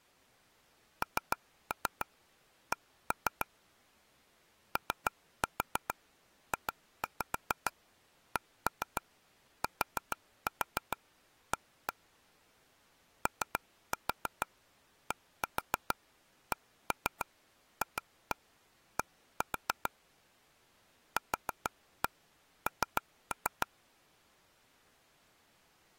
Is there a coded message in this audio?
Yes: tap code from 1.0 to 23.7 s, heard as taps on a table, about 6 knocks a second. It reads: NC OJCTA ODCFD QN